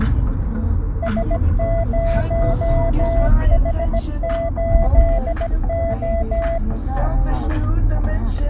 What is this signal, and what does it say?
Morse code, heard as a keyed tone, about 17 wpm, 670 Hz, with the noise inside a car. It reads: S0H8O